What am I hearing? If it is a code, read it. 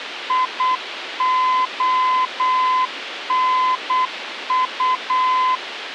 Morse code, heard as a keyed tone, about 8 wpm, 1020 Hz, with radio hiss. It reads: IONU